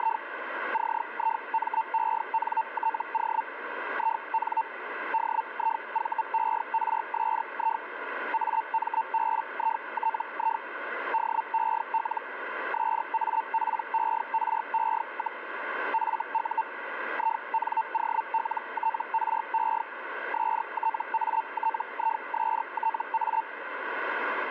Hellschreiber (Feld-Hell, 122.5 baud), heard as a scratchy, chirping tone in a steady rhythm, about 900 Hz, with radio static. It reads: … CIMENTO IN DIVERSI AMBITI DEL SAPERE, FU INOLTRE STATISTA